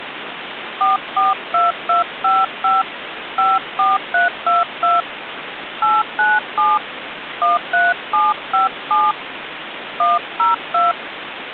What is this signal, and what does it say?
DTMF, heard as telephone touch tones, dialled by hand, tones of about 170 ms, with phone line noise. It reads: 442255 54322 897 13757 102